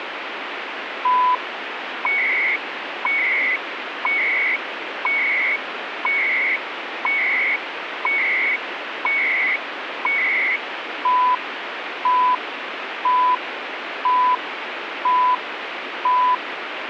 Radio time signal (CHU, Canada), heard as beeps and data bursts, one a second, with radio static.